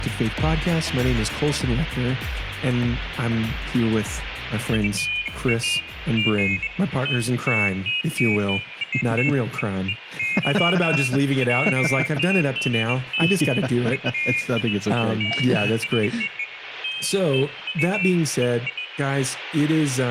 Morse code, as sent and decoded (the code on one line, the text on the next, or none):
none